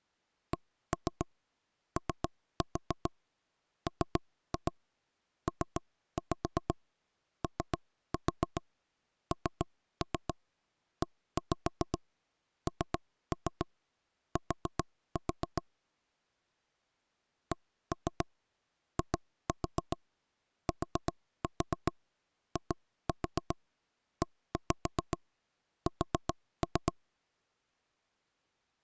Tap code, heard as knocks on wood, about 7 knocks a second. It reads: COMPONENT CITIES